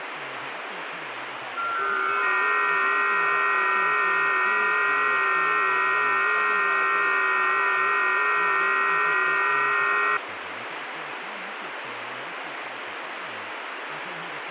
FT8 (several signals at once), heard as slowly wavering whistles, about 6.25 baud, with radio static.